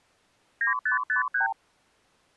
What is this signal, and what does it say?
Multi-frequency trunk signalling (R2, with the far end's replies), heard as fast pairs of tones, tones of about 120 ms. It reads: 9553